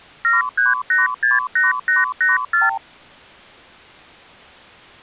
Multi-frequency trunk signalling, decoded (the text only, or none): 73868884